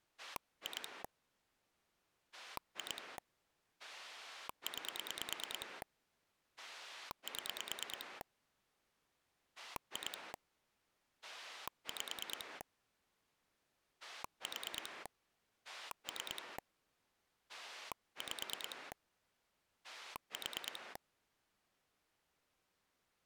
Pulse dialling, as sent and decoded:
2 / 2 / 9 / 7 / 2 / 5 / 4 / 3 / 5 / 4
2 2 9 7 2 5 4 3 5 4

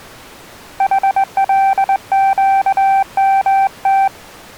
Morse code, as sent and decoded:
.... .-.. --.- -- -
HLQMT

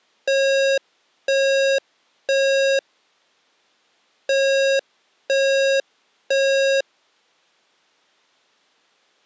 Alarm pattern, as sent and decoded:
3 beeps and a pause
temporal three

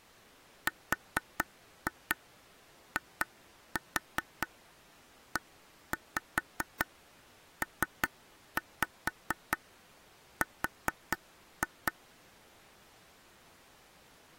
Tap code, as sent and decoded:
4-2 2-4 1-5 3-5 4-2
RIEPR

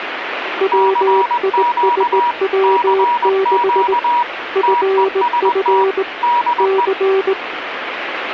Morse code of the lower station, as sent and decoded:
.-- .. ... .-- -.... / ..-. ..-. / -.-.
WISW6 FF C

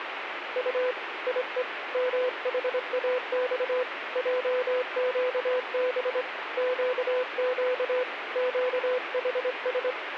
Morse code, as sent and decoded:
..- / .. . / -- .... .- -..- / .--- --.- -... / --.- --.- / --.- .... ...
U IE MHAX JQB QQ QHS

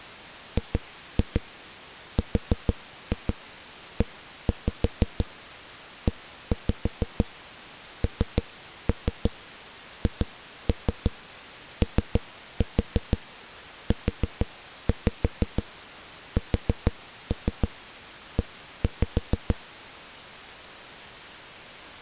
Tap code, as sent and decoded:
2-2 4-2 1-5 1-5 3-3 2-3 3-4 4-5 4-3 1-5
GREENHOUSE

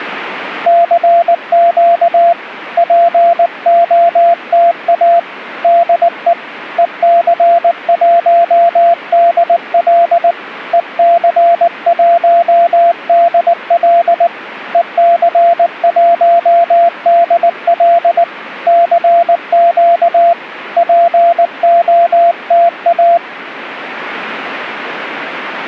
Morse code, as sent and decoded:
-.-. --.- / .--. --- - .- / -.. . / . -.-. .---- -.. .-.. / . -.-. .---- -.. .-.. / . -.-. .---- -.. .-.. / -.-. --.- / .--. --- - .-
CQ POTA DE EC1DL EC1DL EC1DL CQ POTA

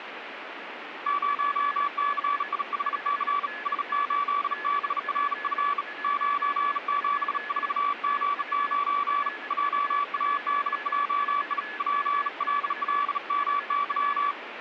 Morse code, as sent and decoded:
----- -.-. .. .... -.-. / ... ---.. -... .-. ..-. / ----. --... ....- --. ----. / .--- .- -.. .--- .. / .--. .-.. .-.. -- -.--
0CIHC S8BRF 974G9 JADJI PLLMY

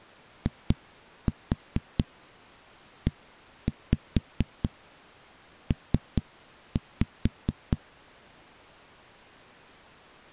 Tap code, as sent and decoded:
2-4 1-5 3-5
IEP

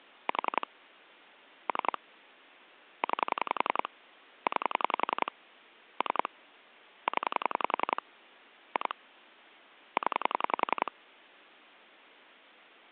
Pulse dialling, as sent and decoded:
4 / 3 / 9 / 9 / 3 / 10 / 2 / 10
4 3 9 9 3 0 2 0

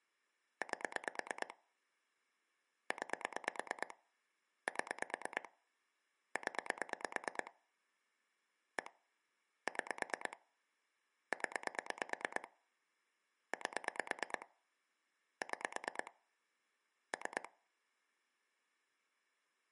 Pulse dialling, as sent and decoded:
8 / 9 / 7 / 10 / 1 / 6 / 10 / 8 / 6 / 3
8 9 7 0 1 6 0 8 6 3

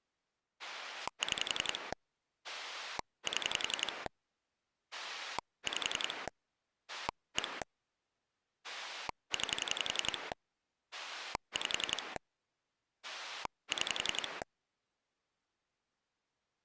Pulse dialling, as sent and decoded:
6 / 7 / 5 / 1 / 9 / 5 / 6
6 7 5 1 9 5 6

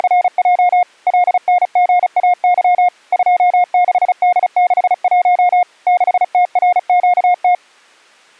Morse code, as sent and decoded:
… / .-.. -. --. .- -.-- / ..--- -.... -.. -.... .---- / -.... - .-. --.- -
… LNGAY 26D61 6TRQT

